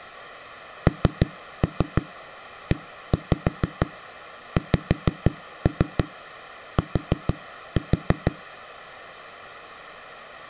Tap code, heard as knocks on a wall, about 6 knocks a second. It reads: NEXT